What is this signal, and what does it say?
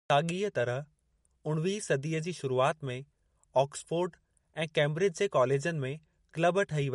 Speech in Sindhi. There is no code.